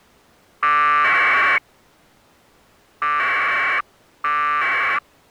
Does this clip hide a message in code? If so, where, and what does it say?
Yes: packet radio (AX.25, as in APRS), 1200 baud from 0.6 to 5.0 s, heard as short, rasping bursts.